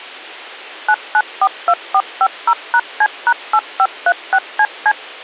DTMF, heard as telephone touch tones, dialled by machine, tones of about 60 ms. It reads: 9942450#C#8536CC